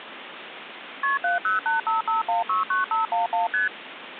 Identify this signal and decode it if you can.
Multi-frequency trunk signalling (R1, as on North American trunks), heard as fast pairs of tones, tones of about 140 ms, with phone line noise. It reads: KP 70855169511 ST